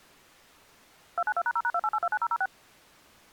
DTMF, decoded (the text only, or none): 292#0#28829006